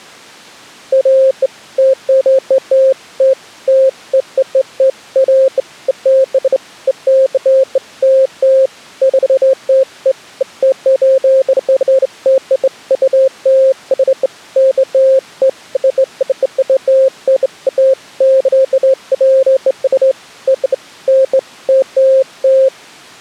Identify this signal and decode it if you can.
Beeps of irregular length. There is no code.